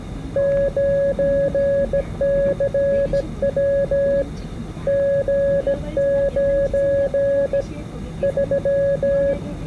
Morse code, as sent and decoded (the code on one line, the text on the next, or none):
----. -.-. .-- / --. ----. / ...--
9CW G9 3